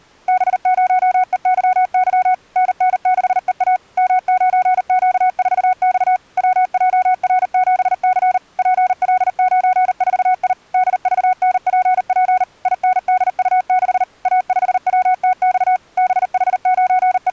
Morse code, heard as a keyed tone, machine-sent, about 39 wpm, 740 Hz. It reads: B0EYY NN6EA M9Q4X WJR7C PL94I DVNPP INDU6 A5WTX …